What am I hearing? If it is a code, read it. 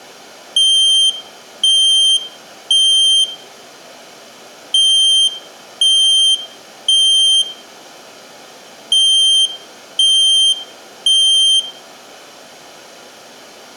Alarm pattern, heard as an alarm's beeps, played three times, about 3150 Hz, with room echo. Temporal three. Smoke or fire, evacuate.